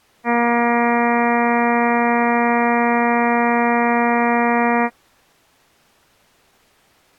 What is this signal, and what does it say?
Ship horn signal, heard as a ship's horn, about 240 Hz. 1 long. At sea: a vessel nearing a blind bend, or under power and making way in fog.